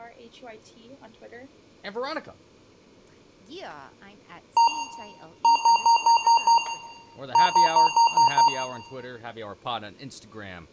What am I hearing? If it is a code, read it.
Beep code, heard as beeps from a small speaker, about 930 Hz, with room echo and speech in English. 1-6-6.